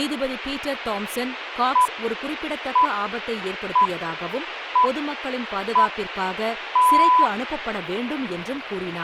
Radio time signal (six pips, as the Greenwich Time Signal), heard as pips, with radio hiss and speech in Tamil.